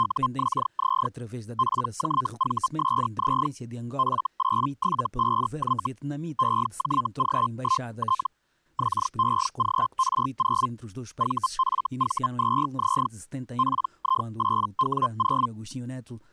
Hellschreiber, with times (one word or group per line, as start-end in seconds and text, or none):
0.0-1.1 …
1.6-3.5 PJVSZ
4.0-5.9 F875Y
6.4-8.3 EJG1T
8.8-10.7 XEGR0
11.2-13.1 VFV2Z
13.6-15.5 PI8W0